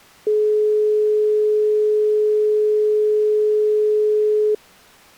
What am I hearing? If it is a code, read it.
Telephone call progress tone (425 Hz plan, as in most of Europe), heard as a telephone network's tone, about 420 Hz. Dial tone.